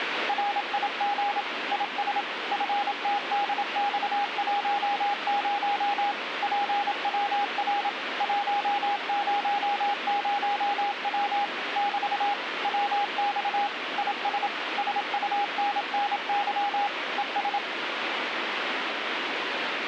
Morse code, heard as a keyed tone, machine-sent, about 27 wpm, 810 Hz, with radio static. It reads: RIG IS FTDX10 PWR 100W <BT> WX IS SUNNY ES